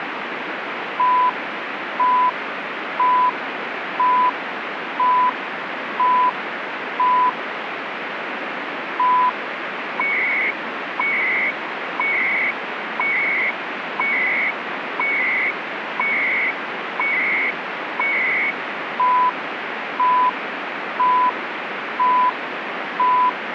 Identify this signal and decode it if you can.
Radio time signal (CHU, Canada), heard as beeps and data bursts, one a second, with radio static.